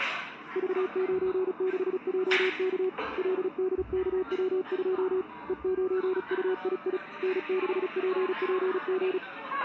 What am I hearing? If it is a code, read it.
Morse code, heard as a keyed tone, hand-sent with a paddle, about 36 wpm, 370 Hz, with the noise of a cafe. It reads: V96JK LDKW2 E9UII N6PPG